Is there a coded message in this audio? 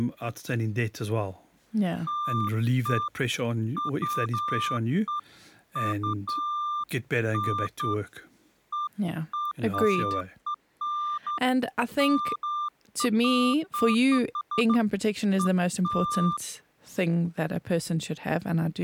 No, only beeps of irregular length, with speech in English.